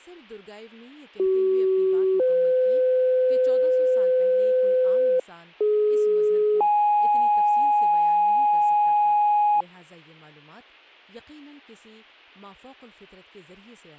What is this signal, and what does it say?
Two-tone page, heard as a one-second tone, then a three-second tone, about 380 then 510 Hz, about 420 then 830 Hz, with speech in Urdu.